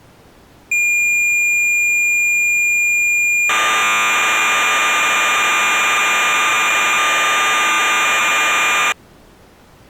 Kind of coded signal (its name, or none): cassette data (Kansas City type)